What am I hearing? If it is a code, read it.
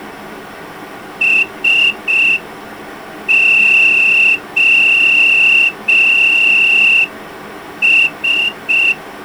Morse code, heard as a whistle, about 5 wpm. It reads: SOS